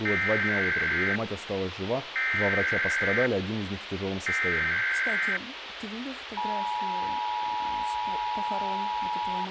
Emergency Alert System (SAME) tones (header bursts, then the 853 and 960 Hz attention tone), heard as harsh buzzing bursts, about 520.83 baud, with radio hiss and speech in Russian.